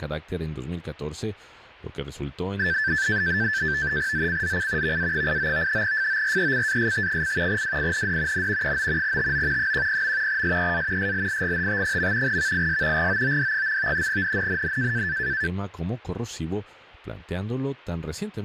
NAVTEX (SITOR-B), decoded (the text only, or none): ZCZC VA89 FORECAST: WIND N 9 TO 10. SEA SLIGHT. VIS GOOD. NNNN